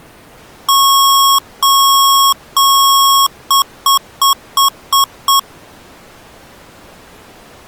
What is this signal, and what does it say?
Beep code, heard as beeps from a small speaker, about 1100 Hz. 3 long, 6 short.